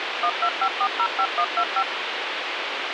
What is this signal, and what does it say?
DTMF, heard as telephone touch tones, dialled by machine, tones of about 70 ms, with radio hiss. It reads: 125405125